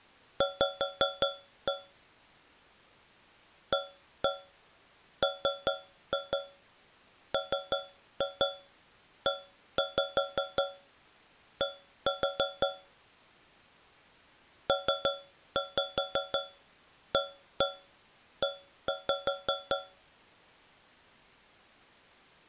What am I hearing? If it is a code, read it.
Tap code, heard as taps on a metal pipe, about 5 knocks a second. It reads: V AMMED PAE